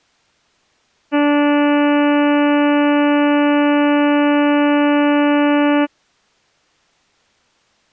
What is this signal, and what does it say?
Ship horn signal, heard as a ship's horn, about 290 Hz. 1 long. At sea: a vessel nearing a blind bend, or under power and making way in fog.